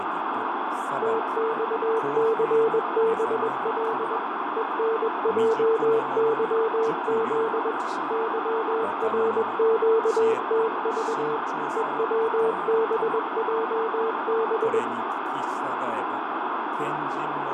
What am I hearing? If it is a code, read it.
Morse code, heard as a keyed tone, machine-sent, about 21 wpm, 450 Hz, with radio static, fading and room echo. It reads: TXCBL ENJYZ YRQTV EWBJB